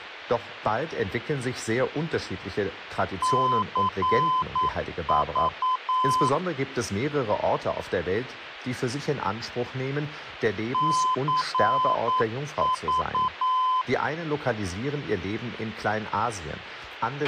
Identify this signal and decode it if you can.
Morse code, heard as a keyed tone, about 9 wpm, 1020 Hz, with a squelch burst at the end and speech in German. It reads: CV CV